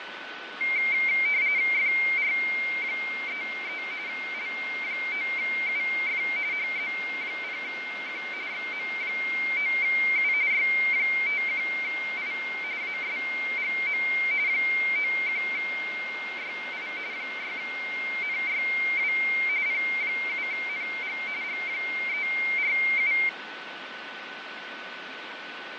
RTTY (45.45 baud, 170 Hz shift), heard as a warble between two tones, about 2200 Hz centre, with radio static, fading and a steady whistle near 1500 Hz. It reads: FR33 L9UF HZ0Q XM9U Y51I ASGM 91YI 6NYW P7NG G347